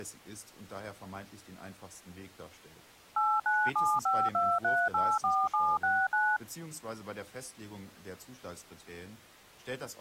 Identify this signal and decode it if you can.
DTMF, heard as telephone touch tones, dialled by machine, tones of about 240 ms, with speech in German. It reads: 89752384769